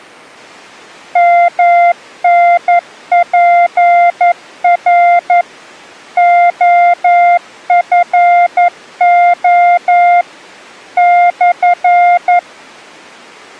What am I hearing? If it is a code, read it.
Morse code, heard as a keyed tone, machine-sent, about 11 wpm, 700 Hz. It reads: MNPR OFO /